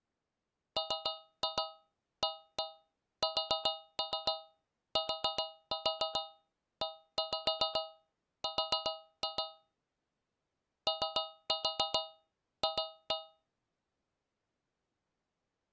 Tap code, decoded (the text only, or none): MASTER OF